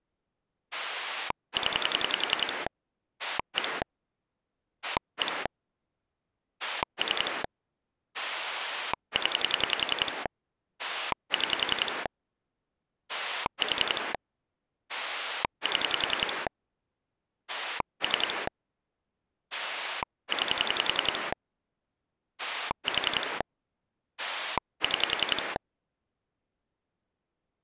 Pulse dialling, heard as a rotary dial, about 10 pulses a second. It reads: 0 1 1 3 0 6 4 7 3 9 4 6